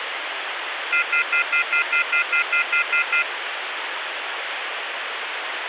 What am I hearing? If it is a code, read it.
Telephone call progress tone (North American plan), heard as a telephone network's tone, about 1400, 2050, 2450, 2600 Hz, 0.1 s on and 0.1 s off, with phone line noise. Off-hook warning tone.